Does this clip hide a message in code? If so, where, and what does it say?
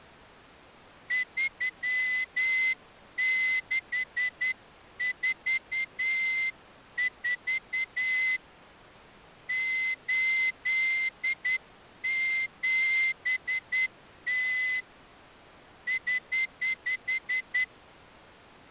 Yes: Morse code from 1.0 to 17.7 s, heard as a whistle, hand-sent with a straight key, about 10 wpm. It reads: 3644 87T <HH>